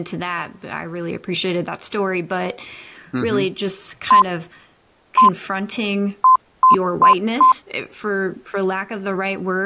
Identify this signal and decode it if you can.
Beep code, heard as beeps, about 1030 Hz, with speech in English. 1-1-4. In Phoenix BIOS tables: BIOS ROM checksum failure.